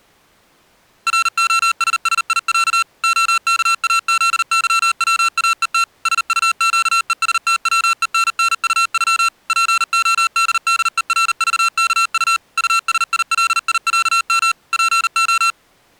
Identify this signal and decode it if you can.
Morse code (Russian alphabet), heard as electronic beeps, machine-sent, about 39 wpm, 1350 Hz. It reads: РОССИЯ ОКАЗЫВАЕТ СУЩЕСТВЕННУЮ ПОДДЕРЖКУ УСИЛИЯМ ПО